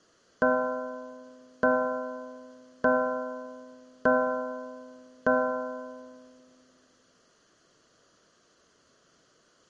Clock strike, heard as a bell, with room echo. 5. Five o'clock.